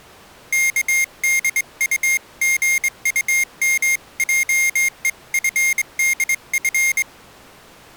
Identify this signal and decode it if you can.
Morse code (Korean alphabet), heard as a high beeper, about 23 wpm, 2150 Hz. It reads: 의심하는